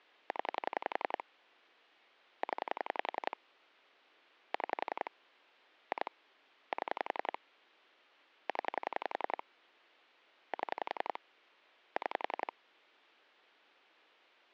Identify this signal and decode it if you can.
Pulse dialling, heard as clicks on a phone line, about 11 pulses a second. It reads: 0 0 6 2 7 0 7 6